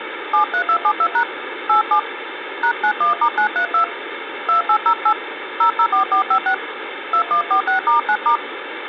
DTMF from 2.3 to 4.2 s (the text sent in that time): #91*932